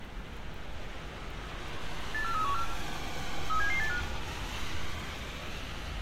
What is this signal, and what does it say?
Five-tone selective call (CCIR), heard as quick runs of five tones, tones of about 100 ms, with room echo and street noise. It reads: 84314 37785